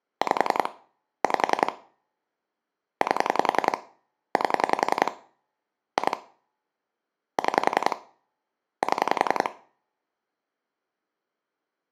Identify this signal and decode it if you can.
Pulse dialling, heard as clicks on a phone line, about 10 pulses a second, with room echo. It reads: 5 5 8 8 2 6 7